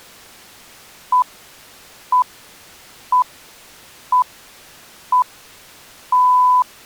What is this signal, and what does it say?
Radio time signal (six pips, as the Greenwich Time Signal), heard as pips.